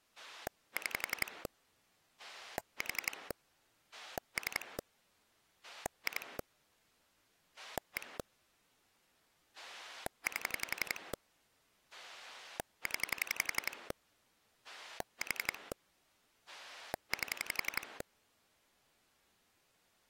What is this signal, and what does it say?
Pulse dialling, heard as a rotary dial, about 11 pulses a second. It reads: 6 4 3 2 1 8 0 4 8